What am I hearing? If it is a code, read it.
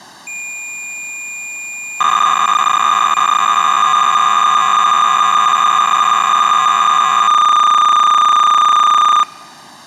Cassette data (Kansas City type), 300 baud, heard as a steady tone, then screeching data.